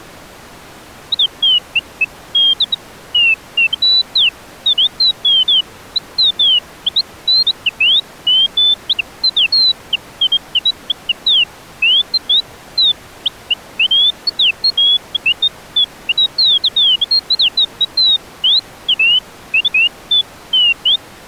Bird-like chirps. There is no code.